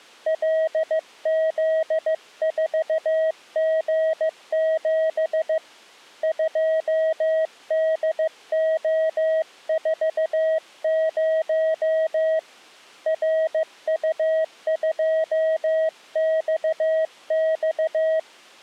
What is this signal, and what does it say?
Morse code, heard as a keyed tone, hand-sent with a paddle, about 15 wpm, 640 Hz. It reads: LZ4G7 2DO40 RU2XX